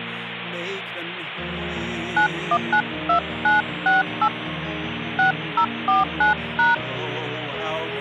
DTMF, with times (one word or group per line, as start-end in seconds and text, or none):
2.2-4.3 9192968
5.2-6.7 6049#